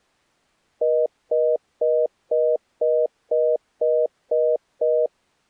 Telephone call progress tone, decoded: congestion tone

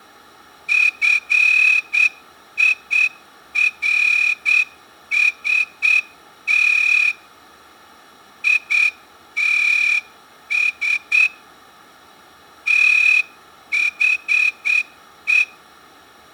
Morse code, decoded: FIRST ITS THE

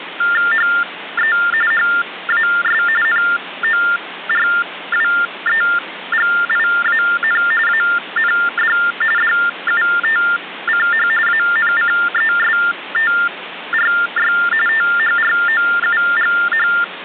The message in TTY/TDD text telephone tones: HE HAS NORWEGIAN AND DUTCH ANCESTRY THROUGH

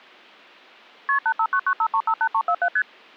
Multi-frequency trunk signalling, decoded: KP 85995358347 ST

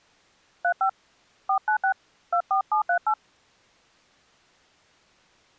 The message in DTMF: 35 496 24738

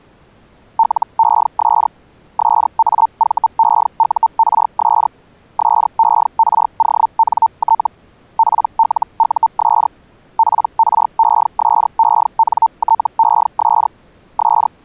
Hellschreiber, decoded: LES SAVEURS SERONT PLUS PRESENTES …

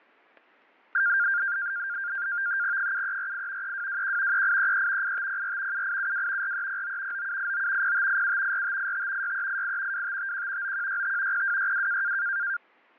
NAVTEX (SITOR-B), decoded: 7348 3221 3833 8504 7872 4309 9789 0587 4585 6388 2551 9165 0262

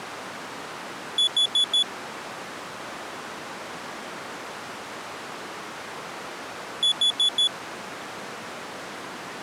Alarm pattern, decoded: temporal four

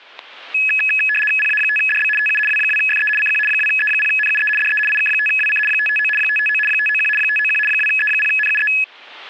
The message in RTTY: PA5DB TU W2FE CQ 2E0NUE DE IK5WC 559 559 591 591 2E0NUE

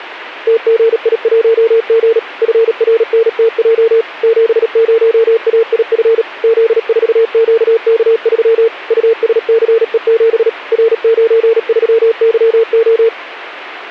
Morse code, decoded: TGI1G FRNTJ 70AIF Z4QK3 USCE7 R93YO

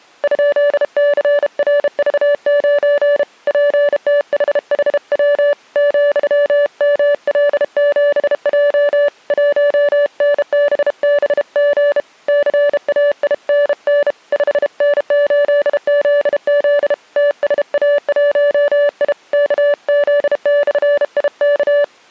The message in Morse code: ?CRV9 PTHHW ,ML7J 1NBBG CAINN 5N8ZZ TSA1I KZ/IK

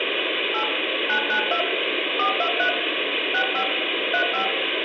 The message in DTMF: 8 992 423 65 35

